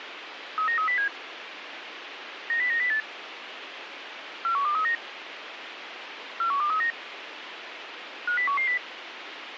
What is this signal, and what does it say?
Five-tone selective call (CCIR), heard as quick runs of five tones, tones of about 100 ms, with radio hiss. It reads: 39307 90908 41239 41239 50110